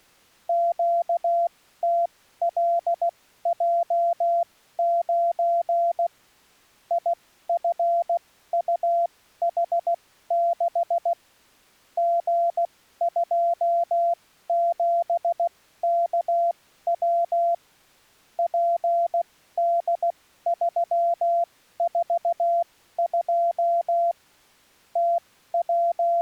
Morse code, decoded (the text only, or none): QTLJ9 IFUH6 G27KW PD342 …